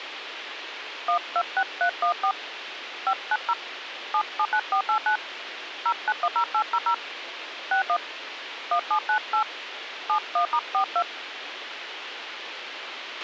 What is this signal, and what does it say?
DTMF, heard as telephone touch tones, dialled by hand, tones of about 80 ms, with radio hiss and a squelch burst at the end. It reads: 126314 590 779489 0910800 61 1798 71*42